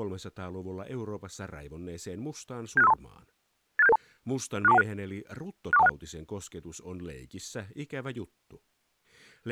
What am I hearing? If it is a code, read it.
Five-tone selective call (EIA), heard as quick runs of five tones, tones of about 30 ms, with speech in Finnish. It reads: 76532 86772 64216 64216